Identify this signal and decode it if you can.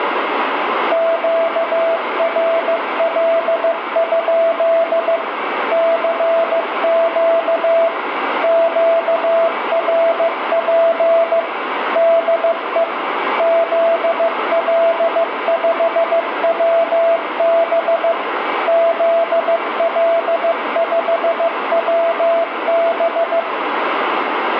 Morse code, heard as a keyed tone, machine-sent, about 15 wpm, 670 Hz, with radio static and room echo. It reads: QRL? CQ QRP DE ZL5WB ZL5WB